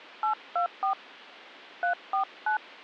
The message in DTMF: 824 349

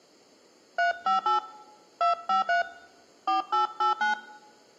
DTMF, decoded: 358 253 4889

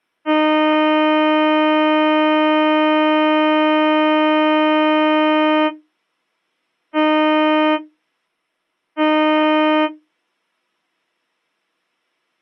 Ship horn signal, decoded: 1 long, 2 short

